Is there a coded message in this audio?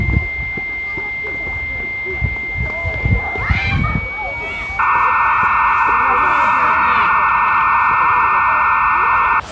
Yes: dial-up modem handshake (low-speed, two carriers) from 0.0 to 9.4 s, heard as two whistles, then hiss, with phone line noise and the noise of a park.